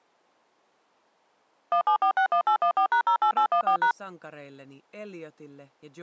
DTMF, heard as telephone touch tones, dialled by machine, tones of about 90 ms. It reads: 17461814#08814#